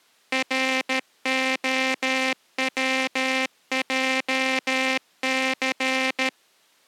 Morse code, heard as a buzzer, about 13 wpm. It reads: ROWJC